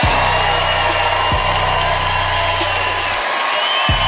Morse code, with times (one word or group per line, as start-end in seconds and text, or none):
none